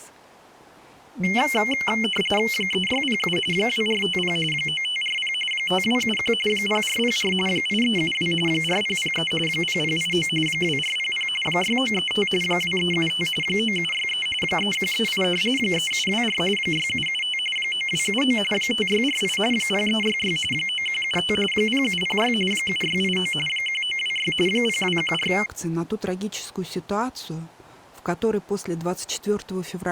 RTTY (45.45 baud, 850 Hz shift), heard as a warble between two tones, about 2550 Hz centre. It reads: 3607 2450 9540 5271 0404 8372 4003 0089 2400 6935 2375 9763 3138 3724 6775 9279 5648 0366 9175 0706 7689 1926 0214